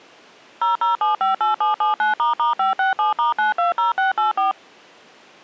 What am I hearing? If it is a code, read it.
DTMF, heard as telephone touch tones, dialled by machine, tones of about 140 ms. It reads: 00758779**567*920684